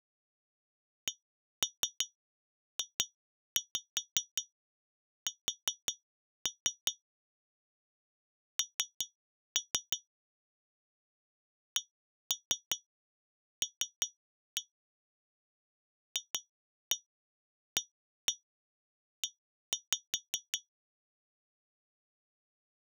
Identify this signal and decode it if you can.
Tap code, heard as taps on glass, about 5 knocks a second. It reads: CJS N CL FAE